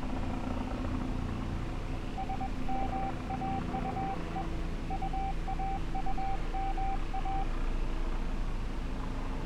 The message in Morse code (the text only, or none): SMAUE UAUMA